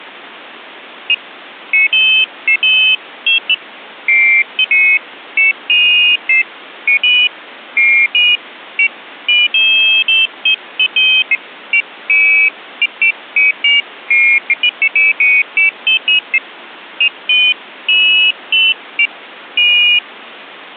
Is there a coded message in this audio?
No, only pairs of high tones at irregular times.